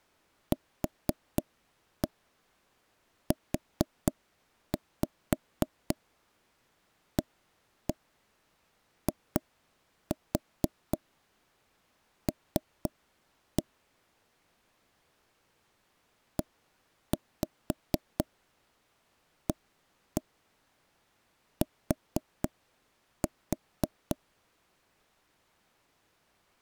Tap code, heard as taps on a table, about 4 knocks a second. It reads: QUAIL EAT